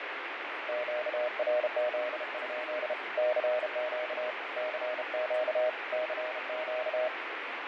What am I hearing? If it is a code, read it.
Morse code, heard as a keyed tone, hand-sent with a bug key, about 32 wpm, 620 Hz, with heavy radio static, fading and speech in Santali. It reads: QRZ? CQ CQ CQ